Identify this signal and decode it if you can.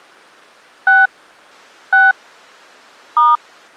DTMF, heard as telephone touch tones, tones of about 190 ms. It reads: 6 6 *